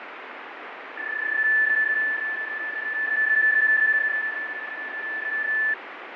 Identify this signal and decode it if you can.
PSK31 (31.25 baud), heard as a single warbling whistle, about 1750 Hz, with radio static and fading.